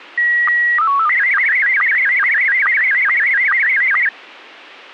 SSTV (slow-scan television), Scottie S1, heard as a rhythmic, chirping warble.